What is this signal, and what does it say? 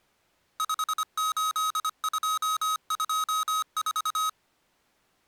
Morse code, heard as electronic beeps, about 25 wpm, 1270 Hz. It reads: 58224